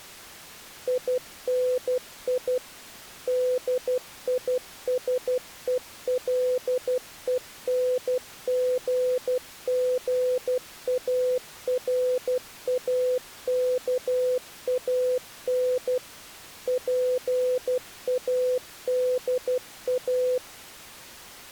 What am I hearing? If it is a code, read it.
Morse code, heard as a keyed tone, machine-sent, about 12 wpm, 500 Hz. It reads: INI DISELENGGARAKAN PADA